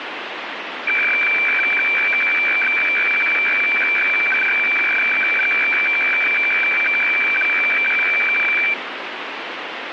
Weather fax (radiofax), 120 lines a minute, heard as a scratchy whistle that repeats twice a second, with radio static.